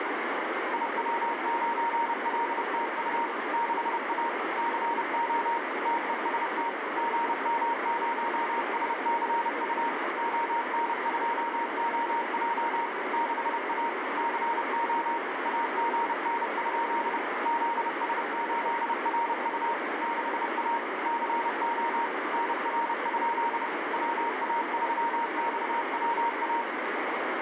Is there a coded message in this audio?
Yes: Morse code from 0.7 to 26.7 s, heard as a keyed tone, machine-sent, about 30 wpm, 930 Hz, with heavy radio static. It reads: IW9LTU 6A CO TEST GM0SCU ON2OJ 6A CO AGN? ZS8RU 6A CO NR? WA3XWA